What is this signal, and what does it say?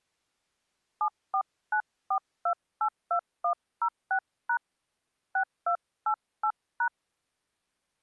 DTMF, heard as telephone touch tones, dialled by hand, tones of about 80 ms. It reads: 7494282106# 6288#